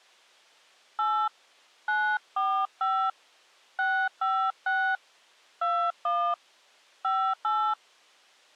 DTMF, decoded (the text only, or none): 8 945 656 21 58